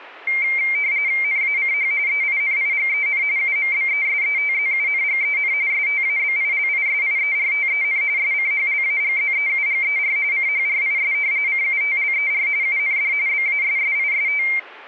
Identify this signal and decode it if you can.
RTTY (45.45 baud, 170 Hz shift), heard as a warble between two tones, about 2200 Hz centre. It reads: NACH EINIGEN UMBESETZUNGEN STABILISIERTEN SCHLAGZEUGER CHRIS CUTLER UND BASSIST